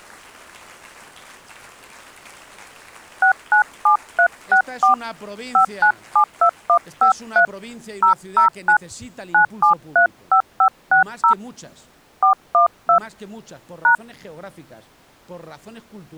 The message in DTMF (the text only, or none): 697364 5972153 009 9735560 412 #